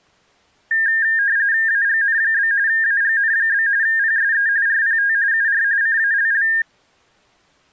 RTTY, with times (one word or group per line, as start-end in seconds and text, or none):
1.7-2.5 AGN?
2.7-3.7 AGN?
3.8-4.5 PSE
4.7-5.1 RPT
5.3-5.6 UR
5.8-6.5 CALL